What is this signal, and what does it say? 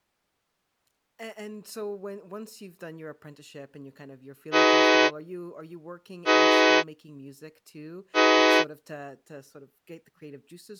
Train horn signal, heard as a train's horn, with speech in English. 3 short. On North American railways: when stopped, the train will back up.